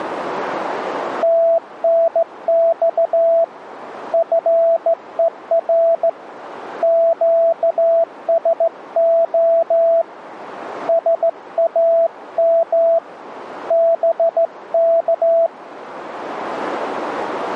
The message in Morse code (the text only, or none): TNX FER QSO SAM BK